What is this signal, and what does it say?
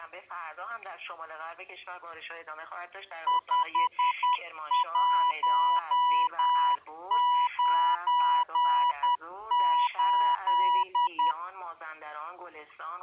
Morse code, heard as a keyed tone, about 10 wpm, 980 Hz. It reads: 5198